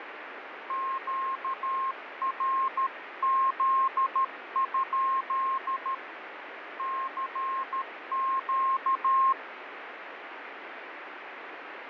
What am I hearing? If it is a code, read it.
Morse code, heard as a keyed tone, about 13 wpm, 1070 Hz, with radio static and fading. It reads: QRZ? CQ